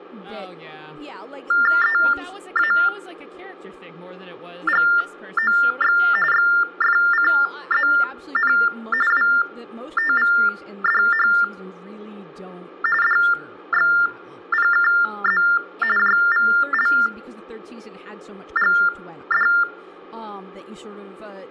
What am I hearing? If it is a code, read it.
TTY/TDD text telephone tones (45.45 baud Baudot), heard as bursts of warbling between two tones, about 400 Hz shift, 1600 Hz centre, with speech in English. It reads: EAGOX XFCZN WTVDH DXPKZ JVLGD